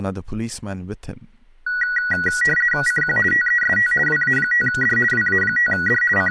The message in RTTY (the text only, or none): CQ TEST WA5D WA5D …